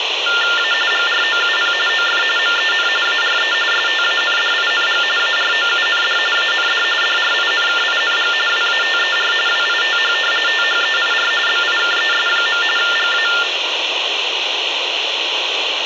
TTY/TDD text telephone tones (45.45 baud Baudot), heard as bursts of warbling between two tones, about 400 Hz shift, 1600 Hz centre, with phone line noise. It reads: A GROUP OF MEN ARE STANDING AROUND AND DRINKING WATER WITH THEIR BIKES. GA